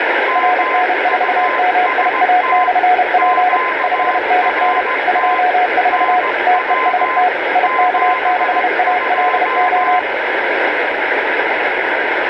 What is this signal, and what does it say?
Morse code, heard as two keyed tones, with heavy radio static and room echo. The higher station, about 17 wpm, 1030 Hz: MUST QRT NW 72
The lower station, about 31 wpm, 730 Hz: RN4MIA/P 5NN 24 TEST IK6ALO